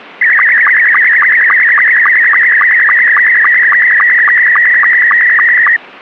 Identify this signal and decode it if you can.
SSTV (slow-scan television), Scottie S2, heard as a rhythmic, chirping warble.